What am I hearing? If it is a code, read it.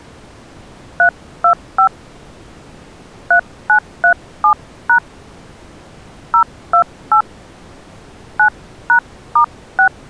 DTMF, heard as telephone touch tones, dialled by hand, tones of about 90 ms. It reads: 325 3937# 028 9#*6